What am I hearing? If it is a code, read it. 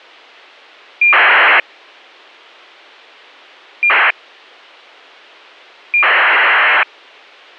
ACARS aircraft data, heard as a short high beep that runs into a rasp, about 2400 baud, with a squelch burst at the end.